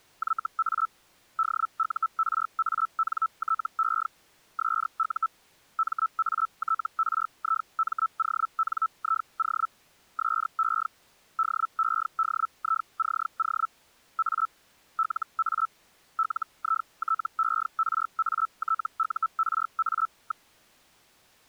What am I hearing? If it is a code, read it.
Hellschreiber (Feld-Hell, 122.5 baud), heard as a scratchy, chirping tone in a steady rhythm, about 1320 Hz. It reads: YA DURANTE SU MATRIMONIO SE DEDICO A LA LITERATURA.